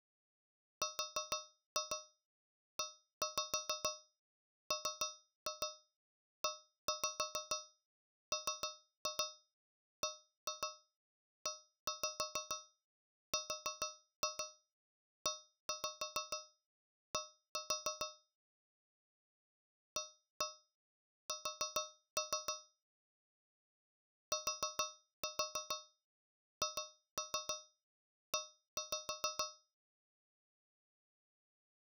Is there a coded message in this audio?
Yes: tap code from 0.8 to 29.7 s, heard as taps on a metal pipe, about 6 knocks a second. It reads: REMEMBERED AS THE